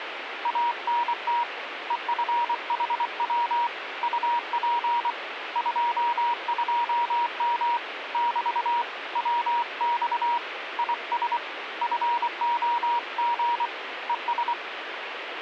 Morse code, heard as a keyed tone, hand-sent with a paddle, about 24 wpm, 950 Hz, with radio static. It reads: ANT EFHW UP 22M <BT> WX IS FOG ES